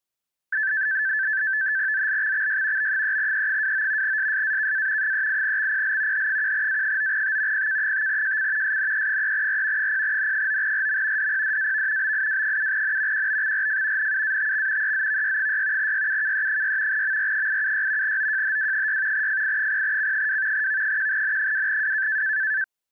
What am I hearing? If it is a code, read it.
NAVTEX (SITOR-B), 100 baud, 170 Hz shift, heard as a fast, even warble, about 1650 Hz centre. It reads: ZLXXY B3E29 SSAKA 38XPL H1A9T PK5JC SNE3R 0N9RM DPDAV BIW7N QBXRF NUATX EZVY6 YUKE6 MR876 OJHW6 FI0C2 V1N2W